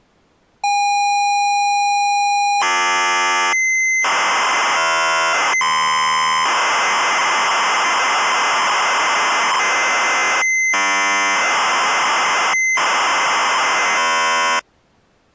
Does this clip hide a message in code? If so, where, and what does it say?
Yes: ZX Spectrum tape loading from 0.6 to 14.6 s, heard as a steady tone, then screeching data.